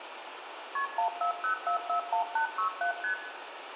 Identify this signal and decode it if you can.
Multi-frequency trunk signalling (R1, as on North American trunks), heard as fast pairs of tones, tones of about 100 ms, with phone line noise and room echo. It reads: KP 140441867 ST